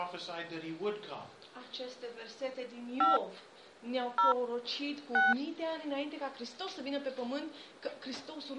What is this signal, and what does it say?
DTMF, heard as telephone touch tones, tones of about 160 ms. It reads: 5 0 6